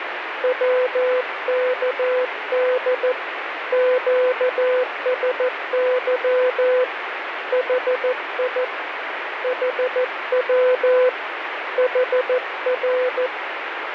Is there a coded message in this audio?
Yes: Morse code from 0.4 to 13.3 s, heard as a keyed tone, hand-sent with a paddle, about 14 wpm, 500 Hz, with radio static. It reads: WKD QSY HI HW HR